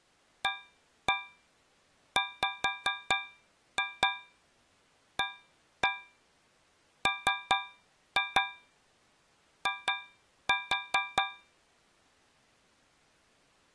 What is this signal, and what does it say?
Tap code, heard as taps on a metal pipe, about 4 knocks a second. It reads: AWAMI